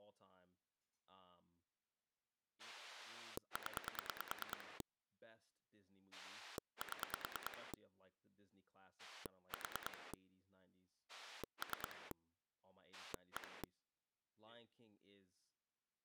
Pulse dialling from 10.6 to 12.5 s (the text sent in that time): 3